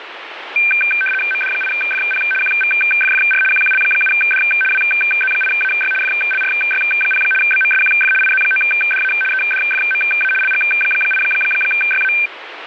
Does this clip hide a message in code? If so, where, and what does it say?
Yes: RTTY (75 baud, 850 Hz shift) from 0.6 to 12.3 s, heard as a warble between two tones, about 1950 Hz centre, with radio static. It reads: MD8FP QVFFR QQL7D WZ8AY FLRY0 BMSQF IZ9DA EDFMA LG8YA